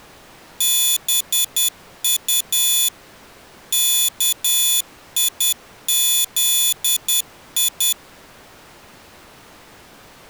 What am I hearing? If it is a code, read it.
Morse code, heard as a high beeper, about 10 wpm, 3450 Hz. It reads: BU KIZI